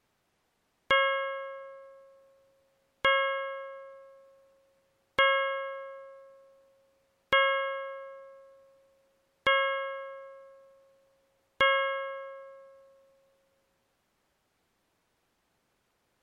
Clock strike, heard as a bell. 6. Six o'clock.